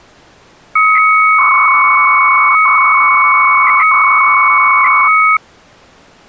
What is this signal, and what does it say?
300-baud modem data (Bell 103 tones), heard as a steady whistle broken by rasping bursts, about 300 baud, 200 Hz shift.